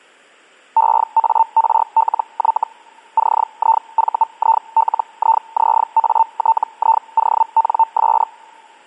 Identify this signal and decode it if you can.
Hellschreiber (Feld-Hell, 122.5 baud), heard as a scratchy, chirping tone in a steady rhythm, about 900 Hz. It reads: EARLY CIVILIZATIONS